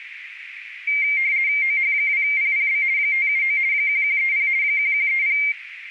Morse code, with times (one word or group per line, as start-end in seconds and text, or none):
none